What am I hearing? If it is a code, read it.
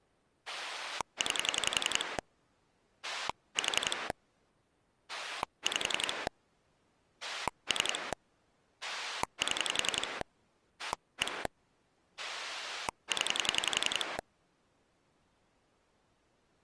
Pulse dialling, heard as a rotary dial, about 11 pulses a second. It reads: 9 4 5 3 7 1 0